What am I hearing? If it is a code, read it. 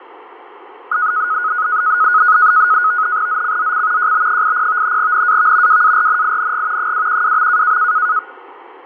NAVTEX (SITOR-B), 100 baud, 170 Hz shift, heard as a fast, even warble, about 1360 Hz centre, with fading and static crashes. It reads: ZCZC JB80 NAV WARNING 212.